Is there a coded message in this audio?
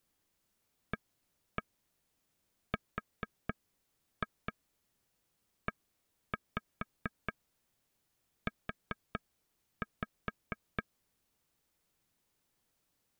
Yes: tap code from 0.9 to 10.8 s, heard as taps on a table, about 4 knocks a second. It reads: AREU